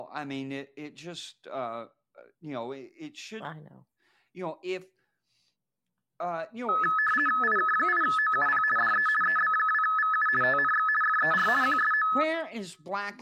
RTTY (50 baud, 450 Hz shift), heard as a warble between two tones, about 1500 Hz centre, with speech in English. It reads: IK8OUP DE EB2VU TNX FER QSO